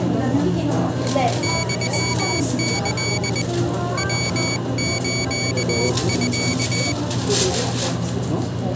Morse code (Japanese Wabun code), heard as a high beeper, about 20 wpm, 2250 Hz, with the noise of a restaurant. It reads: ユキ ヤスミ